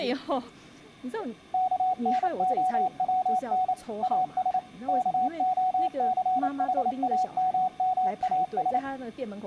Morse code, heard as a keyed tone, machine-sent, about 28 wpm, 740 Hz, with room echo and speech in Chinese. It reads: KNOWN AS KOCHAMMAS